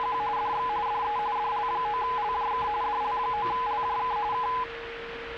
RTTY (45.45 baud, 170 Hz shift), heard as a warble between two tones, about 920 Hz centre, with radio static, a steady whistle near 460 Hz and the noise of a crowd indoors. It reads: … DX DE DL9LJK DL9LJK K